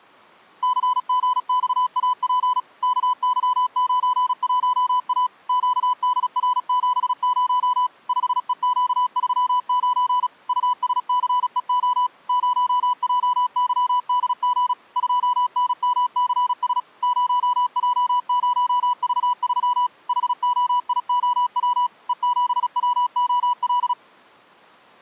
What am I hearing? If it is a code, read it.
Morse code, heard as a keyed tone, machine-sent, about 36 wpm, 990 Hz. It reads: CGXAP KY91A QDR70 5EQ39 USCEO 0JYDG 2NMCS 0J0V3 HOIOW E7WOL